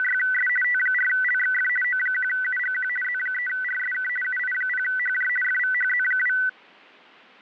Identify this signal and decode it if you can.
RTTY (50 baud, 450 Hz shift), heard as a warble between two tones, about 1750 Hz centre. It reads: … T4LXF O1UGQ Z3RSK UI0HJ FVHZ2